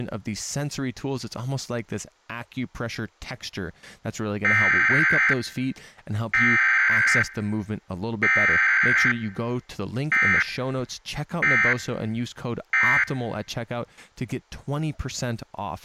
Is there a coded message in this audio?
Yes: Emergency Alert System (SAME) tones (header bursts, then end-of-message bursts) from 4.4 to 13.0 s, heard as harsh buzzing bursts, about 520.83 baud.